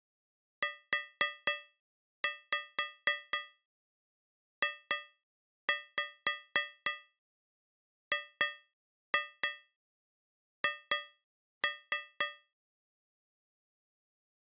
Tap code, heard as taps on a metal pipe, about 4 knocks a second. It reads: UJGH